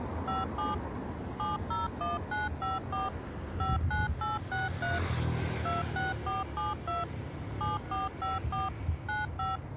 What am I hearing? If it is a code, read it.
DTMF, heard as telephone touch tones, dialled by machine, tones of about 170 ms, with street noise. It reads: 57 701954 59863 26472 7454 95